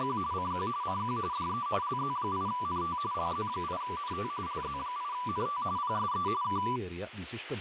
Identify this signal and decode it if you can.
RTTY (45.45 baud, 170 Hz shift), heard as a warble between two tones, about 1080 Hz centre, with radio static and speech in Malayalam. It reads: … CQ CQ DE LZ8NT LZ8NT LZ8NT PSE K